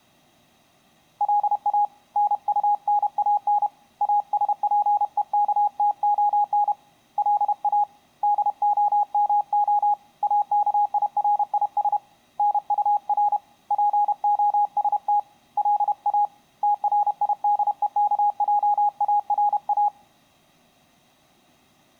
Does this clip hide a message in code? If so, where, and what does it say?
Yes: Morse code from 1.1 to 19.9 s, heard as a keyed tone, hand-sent with a paddle, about 31 wpm, 830 Hz. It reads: LA NUNAN ASPEKTON LA DOMO AKIRIS NUR POST LA TRIDEKJARA